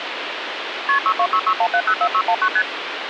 Multi-frequency trunk signalling (R1, as on North American trunks), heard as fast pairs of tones, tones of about 70 ms, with phone line noise. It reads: KP 62661704619 ST